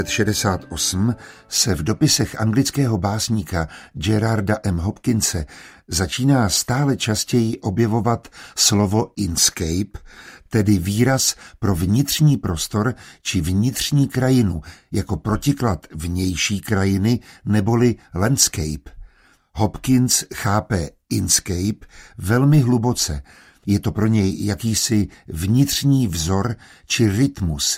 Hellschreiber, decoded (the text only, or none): none